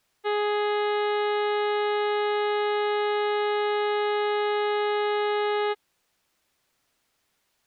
Ship horn signal, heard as a ship's horn, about 420 Hz. 1 long. At sea: a vessel nearing a blind bend, or under power and making way in fog.